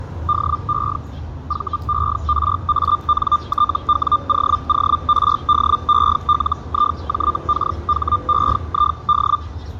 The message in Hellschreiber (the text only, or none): DE VERANTWOORDELIJKHEID